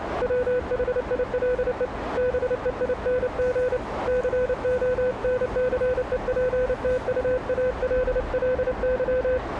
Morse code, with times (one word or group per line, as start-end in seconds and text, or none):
0.2-1.9 WHILE
2.2-3.8 BEING
4.1-9.4 CONCEPTUALLY